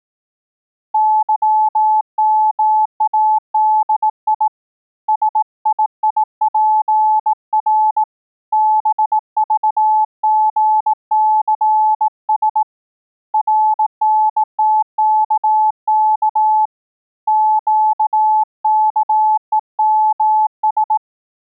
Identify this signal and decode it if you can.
Morse code, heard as a keyed tone, hand-sent with a bug key, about 18 wpm, 860 Hz. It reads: YMADI SIIPR BVGCS RNTKK QKEMS